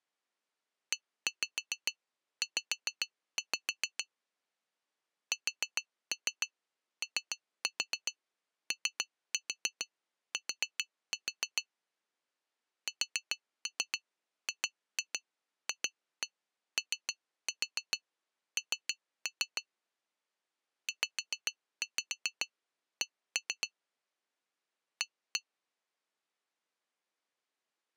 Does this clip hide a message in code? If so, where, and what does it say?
Yes: tap code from 0.9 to 25.4 s, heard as taps on glass, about 7 knocks a second. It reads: EZ SOOT SGFON ZC A